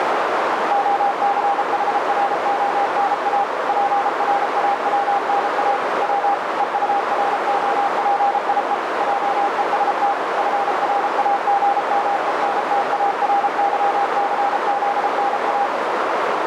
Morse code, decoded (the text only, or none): OCHRONA PRAWNA W EUROPIE JEST FRAGMENTARYCZNA